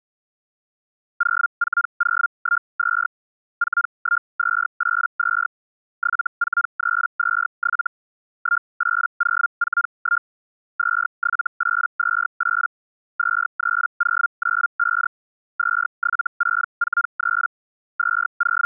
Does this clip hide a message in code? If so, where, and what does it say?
Yes: Hellschreiber (Feld-Hell, 122.5 baud) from 1.2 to 18.7 s, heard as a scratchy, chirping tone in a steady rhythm, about 1400 Hz. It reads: 04012 41282 74327 18041 27828 23095 27643 …